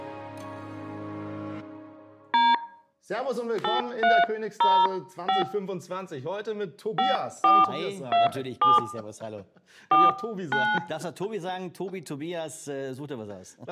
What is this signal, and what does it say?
DTMF, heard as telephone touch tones, dialled by hand, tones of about 190 ms. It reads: D 8305 5427 49